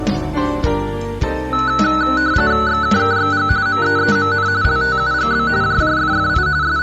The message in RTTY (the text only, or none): XKKXG MEEMN LTUGB JJFFI …